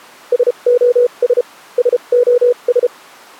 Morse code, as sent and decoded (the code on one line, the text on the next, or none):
... --- ... / ... --- ...
SOS SOS